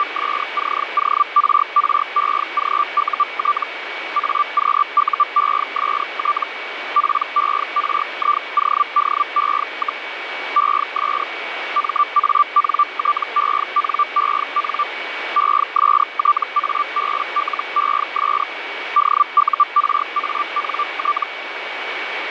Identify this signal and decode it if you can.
Hellschreiber (Feld-Hell, 122.5 baud), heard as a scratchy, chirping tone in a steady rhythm, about 1180 Hz, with radio static and a steady whistle near 2260 Hz. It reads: … AQUEST PERIODE, ES MANTENEN ESTABLES DURANT